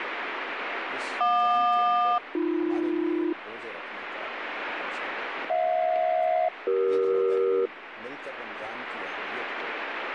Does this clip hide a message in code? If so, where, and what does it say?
Yes: aircraft SELCAL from 1.2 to 7.7 s, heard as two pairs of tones, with radio static. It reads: JQ-AB HJ-CE